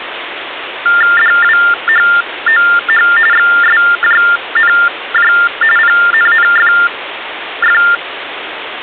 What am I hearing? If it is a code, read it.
TTY/TDD text telephone tones (45.45 baud Baudot), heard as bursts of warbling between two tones, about 400 Hz shift, 1600 Hz centre, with phone line noise. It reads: DWHOH XSJNJ PNNFF